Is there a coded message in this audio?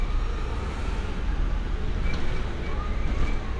No, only street noise.